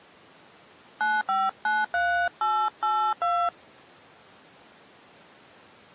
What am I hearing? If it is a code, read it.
DTMF, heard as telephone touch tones, dialled by hand, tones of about 280 ms. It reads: 9593882